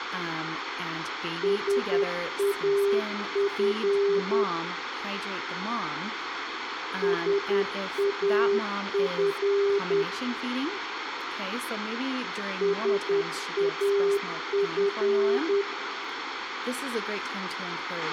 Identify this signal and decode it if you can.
Morse code, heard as a keyed tone, machine-sent, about 10 wpm, 400 Hz, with radio hiss, a squelch burst at the end, room echo and speech in English. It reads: SAF SAF SAF